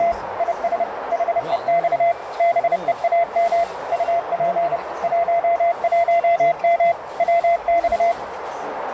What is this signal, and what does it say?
Morse code, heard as a keyed tone, machine-sent, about 30 wpm, 680 Hz, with radio static, a narrow filter and the noise of a restaurant. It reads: … IS HEX BEAM UP 11M WX